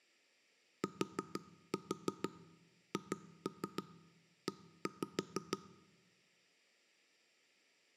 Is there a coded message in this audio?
Yes: tap code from 0.8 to 5.6 s, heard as knocks on wood, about 6 knocks a second. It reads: THE